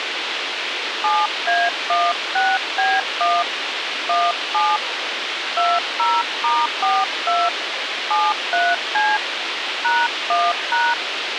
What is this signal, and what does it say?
DTMF, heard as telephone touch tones, dialled by hand, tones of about 220 ms, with radio hiss. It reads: 7A16B1 17 20*42 73C #1#